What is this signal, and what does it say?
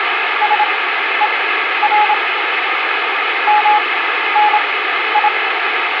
Morse code (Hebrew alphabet), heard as a keyed tone, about 27 wpm, spaced as for 12 wpm, 840 Hz, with heavy radio static. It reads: שור מני